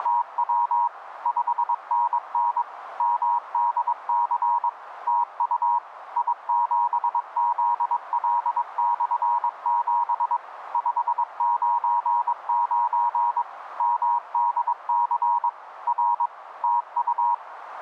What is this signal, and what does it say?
Morse code, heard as a keyed tone, machine-sent, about 22 wpm, 950 Hz, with radio static and a narrow filter. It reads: … 5NN MDC TU I7ZL/7 599 MDC R TU